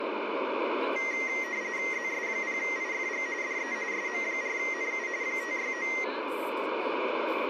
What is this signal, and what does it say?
RTTY (45.45 baud, 170 Hz shift), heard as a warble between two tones, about 2000 Hz centre, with radio static and speech in English. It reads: ZS0IFG DE SM4NU 569